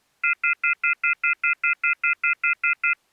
Telephone call progress tone (North American plan), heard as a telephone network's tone, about 1400, 2050, 2450, 2600 Hz, 0.1 s on and 0.1 s off. Off-hook warning tone.